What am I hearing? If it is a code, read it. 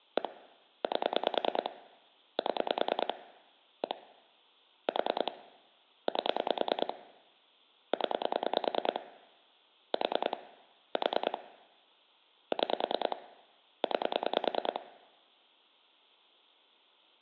Pulse dialling, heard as clicks on a phone line, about 9 pulses a second. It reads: 1 8 7 1 4 8 0 4 4 6 9